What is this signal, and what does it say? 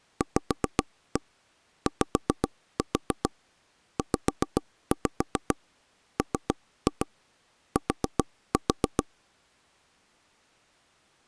Tap code, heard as taps on a table, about 7 knocks a second. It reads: VYZMT